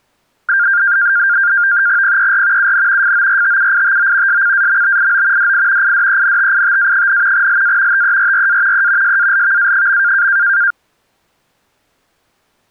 NAVTEX (SITOR-B), 100 baud, 170 Hz shift, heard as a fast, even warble, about 1500 Hz centre. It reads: PER UN FORTUITO SCAMBIO DI IDENTITA, LA TERRA E SALVA.